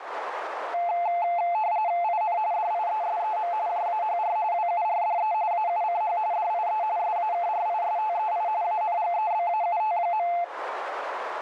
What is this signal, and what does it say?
RTTY (45.45 baud, 170 Hz shift), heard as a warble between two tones, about 780 Hz centre, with radio static and a narrow filter. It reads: IN DIESEM JAHR WURDE AUCH DIE SAKRISTEI ANGEBAUT.